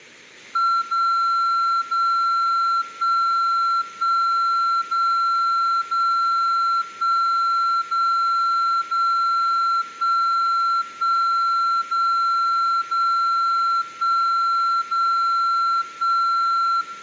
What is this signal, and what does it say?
Radio time signal (DCF77), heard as a tone whose level steps once a second, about 1360 Hz, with room echo. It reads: 0 0 1 1 0 0 1 0 0 1 1 0 0 1 0 1